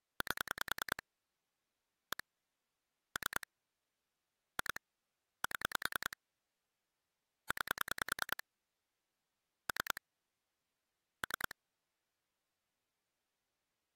Pulse dialling, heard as clicks on a phone line, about 10 pulses a second. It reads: 8 1 3 2 7 9 3 3